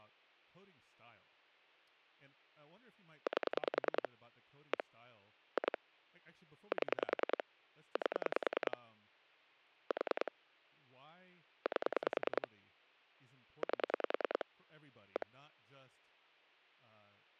Pulse dialling, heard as clicks on a phone line, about 10 pulses a second, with hum and speech in English. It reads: 8 1 2 7 8 4 8 8 1